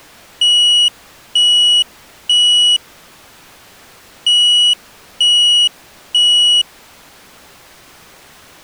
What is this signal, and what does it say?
Alarm pattern, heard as an alarm's beeps, played twice, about 2900 Hz. Temporal three. Smoke or fire, evacuate.